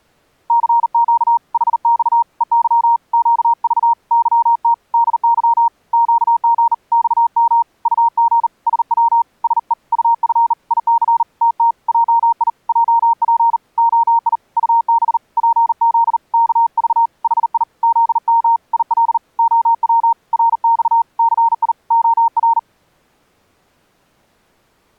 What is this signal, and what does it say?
Morse code, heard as a keyed tone, hand-sent with a bug key, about 39 wpm, 930 Hz. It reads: CQ HX EY QV YT DY QG XM UG SW SE UF IC TT JI JP OI UB PZ KV HI ZM IL OW RX CI OR